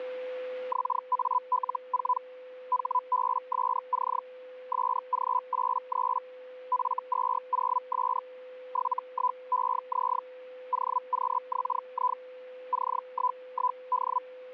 Hellschreiber (Feld-Hell, 122.5 baud), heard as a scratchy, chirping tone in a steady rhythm, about 1000 Hz, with a steady whistle near 510 Hz. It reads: XAL4 HBSC SG83 F20S 71EZ OQXI C11D